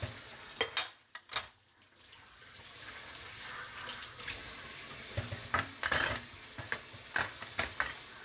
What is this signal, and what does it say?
Kitchen noise. There is no code.